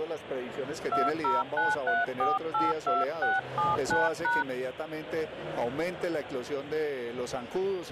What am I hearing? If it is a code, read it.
DTMF, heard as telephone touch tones, dialled by hand, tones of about 180 ms. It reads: 2093482679#